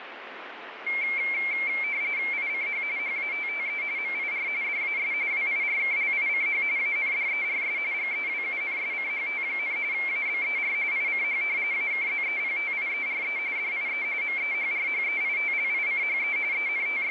RTTY (45.45 baud, 170 Hz shift), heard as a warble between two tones, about 2250 Hz centre, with radio static. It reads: ICH HATTE MIR DAS WIRKLICH ANDERS GEWUNSCHT, ABER ICH AKZEPTIERE DIE MEHRHEITLICHE …